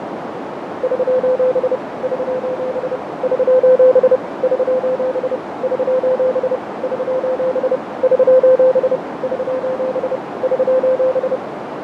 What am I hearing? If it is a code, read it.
Morse code, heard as a keyed tone, machine-sent, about 30 wpm, 510 Hz, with heavy radio static, fading and a narrow filter. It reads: <SOS> <SOS> <SOS> <SOS> <SOS> <SOS> <SOS> <SOS> <SOS>